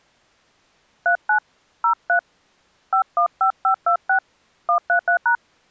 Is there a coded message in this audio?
Yes: DTMF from 1.1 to 5.4 s, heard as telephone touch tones, dialled by hand, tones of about 100 ms. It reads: 39 03 515526 133#